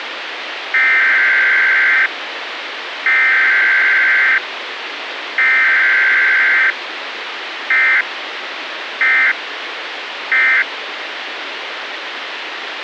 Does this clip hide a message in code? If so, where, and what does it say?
Yes: Emergency Alert System (SAME) tones (header bursts, then end-of-message bursts) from 0.7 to 10.6 s, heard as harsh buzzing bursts, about 520.83 baud, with radio hiss.